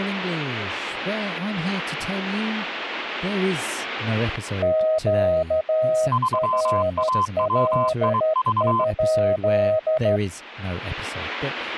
Morse code, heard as two keyed tones, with static crashes and speech in English. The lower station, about 13 wpm, 630 Hz: QRL?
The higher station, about 23 wpm, 1030 Hz: 3AWIV